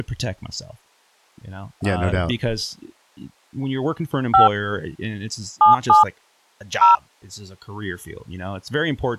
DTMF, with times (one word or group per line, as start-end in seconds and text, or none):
4.3-4.5 5
5.6-6.0 77
6.8-7.0 0